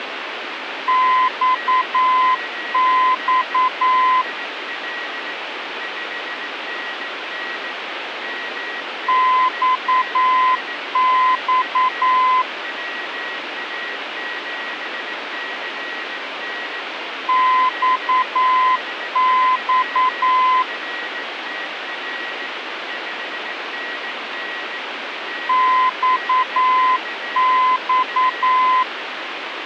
Morse code, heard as a keyed tone, machine-sent, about 9 wpm, 1020 Hz, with radio static and a weaker station near 1910 Hz. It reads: XX XX XX XX